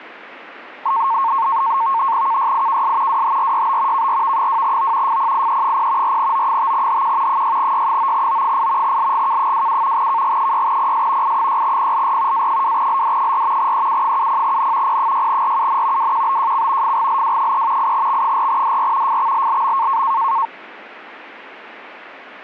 NAVTEX (SITOR-B), 100 baud, 170 Hz shift, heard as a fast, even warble, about 1000 Hz centre. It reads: KYIKS WHRYB KRV2O FPIE0 4O5HQ 6Y9O8 LGK27 KG6PS I6PLR A2LD4 EU70N P6RUN WQBJC FGLW3 8X4DR FXLLM